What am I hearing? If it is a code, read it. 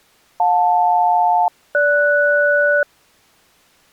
Aircraft SELCAL, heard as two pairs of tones. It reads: JL-GS